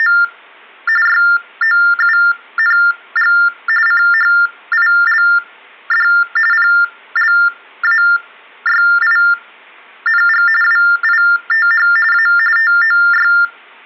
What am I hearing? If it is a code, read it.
TTY/TDD text telephone tones (45.45 baud Baudot), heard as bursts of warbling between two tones, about 400 Hz shift, 1600 Hz centre. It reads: … YOUNG CHILD PLAYING WITH A TOY